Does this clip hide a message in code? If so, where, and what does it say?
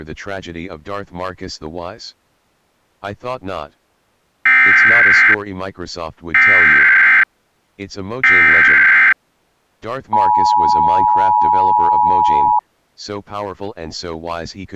Yes: Emergency Alert System (SAME) tones (header bursts, then the 853 and 960 Hz attention tone) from 4.5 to 12.6 s, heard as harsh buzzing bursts, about 520.83 baud.